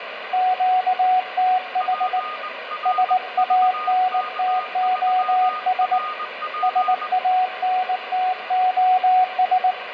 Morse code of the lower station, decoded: QTH SANTOS SANTOS

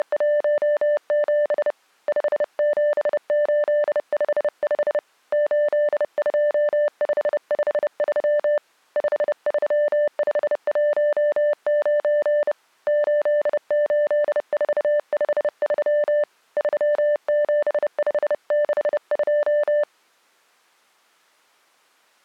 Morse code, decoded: … 57855 82553 53519 88453 37562

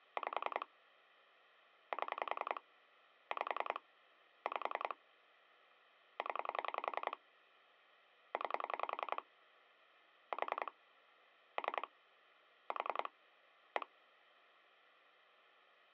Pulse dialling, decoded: 5 7 5 5 0 9 4 3 4 1

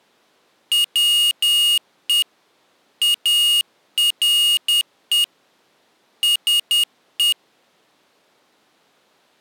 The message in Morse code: WE ARE SE

